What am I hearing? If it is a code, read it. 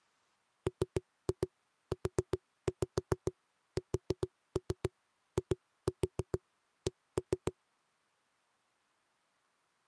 Tap code, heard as knocks on a wall, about 7 knocks a second. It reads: MUSIC